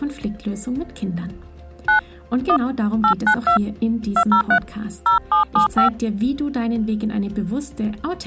DTMF, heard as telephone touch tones, dialled by hand, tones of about 100 ms. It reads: 9 1 892 203 0775